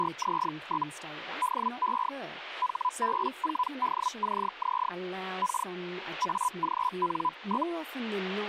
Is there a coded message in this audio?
Yes: Hellschreiber (Feld-Hell, 122.5 baud) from 0.0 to 7.7 s, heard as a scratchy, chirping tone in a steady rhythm, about 1000 Hz, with speech in English. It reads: … DE HB4DCZ K AGN?